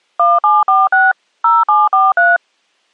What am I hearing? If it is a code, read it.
DTMF, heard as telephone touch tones, dialled by machine, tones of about 190 ms. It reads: 1746 0743